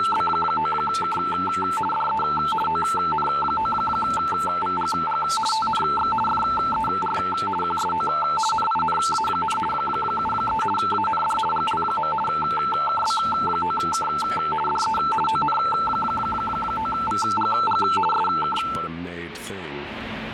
RTTY (50 baud, 450 Hz shift), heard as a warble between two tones, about 1110 Hz centre, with radio static. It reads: … DE ON9VGG TNX FER QSO NINA, 73 AND GL. KB9K DE ON9VGG SK